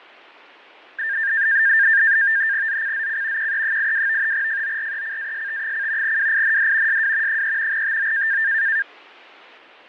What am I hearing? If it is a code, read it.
NAVTEX (SITOR-B), 100 baud, 170 Hz shift, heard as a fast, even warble, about 1700 Hz centre, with fading. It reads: ZCZC QE82 FORECAST: WIND SW 3 TO